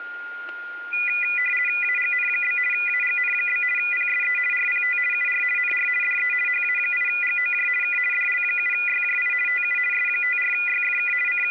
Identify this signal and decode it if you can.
RTTY (50 baud, 450 Hz shift), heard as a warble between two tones, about 2200 Hz centre, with static crashes and a steady whistle near 1420 Hz. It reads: AGN? AGN? PSE RPT UR NR DE HA8GOJ K DL7YJI TU S54YFK …